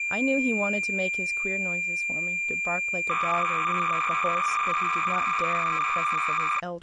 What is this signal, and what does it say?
Cassette data (Kansas City type), 300 baud, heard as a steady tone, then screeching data, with speech in English.